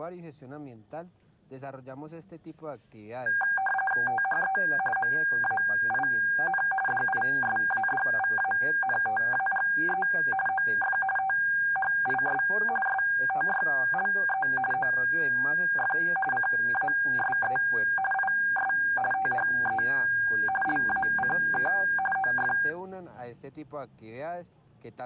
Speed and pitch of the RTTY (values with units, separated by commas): 45.45 baud, 850 Hz shift, 1200 Hz centre